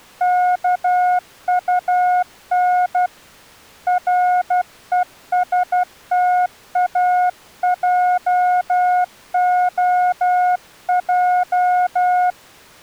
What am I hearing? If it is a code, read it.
Morse code, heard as a keyed tone, hand-sent with a paddle, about 12 wpm, 720 Hz. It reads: KUN RESTAJOJ